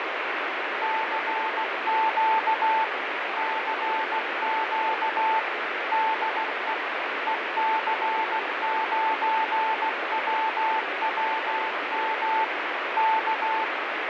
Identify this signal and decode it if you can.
Morse code, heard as a keyed tone, machine-sent, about 16 wpm, 880 Hz, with heavy radio static and fading. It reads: CQ CQ DE EC9WWM K